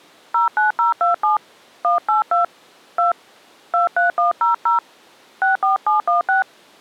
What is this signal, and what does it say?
DTMF, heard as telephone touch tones, dialled by hand, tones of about 140 ms. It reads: 09027 182 2 23100 64716